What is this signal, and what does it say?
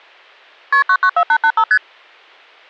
Multi-frequency trunk signalling (R1, as on North American trunks), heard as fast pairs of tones, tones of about 70 ms. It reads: KP 994885 ST